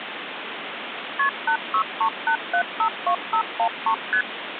Multi-frequency trunk signalling (R1, as on North American trunks), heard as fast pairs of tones, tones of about 80 ms, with phone line noise. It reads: KP 8638752513 ST